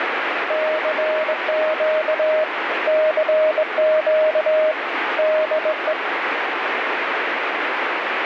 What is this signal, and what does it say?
Morse code, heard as a keyed tone, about 21 wpm, 620 Hz, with heavy radio static. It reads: CQ CQ DE